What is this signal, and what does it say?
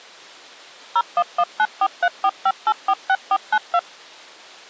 DTMF, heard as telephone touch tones, dialled by machine, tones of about 60 ms. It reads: 01194345846492